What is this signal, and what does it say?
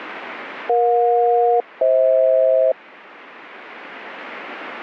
Aircraft SELCAL, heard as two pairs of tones, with radio static. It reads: EJ-FH